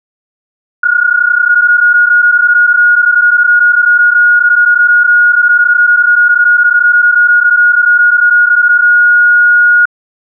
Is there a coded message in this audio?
Yes: PSK31 (31.25 baud) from 0.8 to 9.9 s, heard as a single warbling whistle, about 1440 Hz.